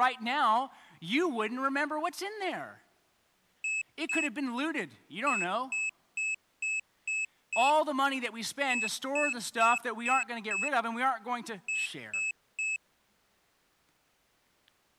Beep code, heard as a piezo beeper, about 2600 Hz, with speech in English. 2-6-5-3.